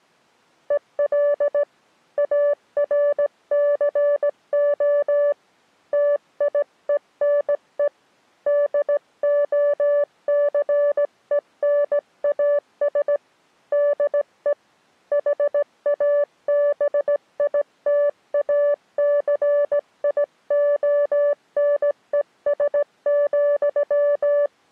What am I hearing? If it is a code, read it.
Morse code, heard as a keyed tone, hand-sent with a straight key, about 17 wpm, 580 Hz. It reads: EL ARCO TIENE DOCENAS DE HABITACIONES,